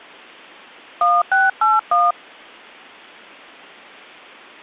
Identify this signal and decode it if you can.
DTMF, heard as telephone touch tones, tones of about 180 ms. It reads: 1681